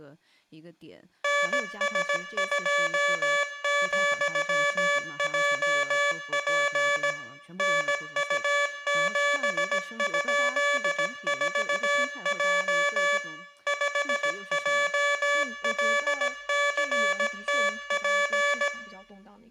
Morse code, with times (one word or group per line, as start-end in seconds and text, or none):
1.2-7.1 NS2,JP
7.6-13.2 NU7?4J
13.7-18.7 5JLCTP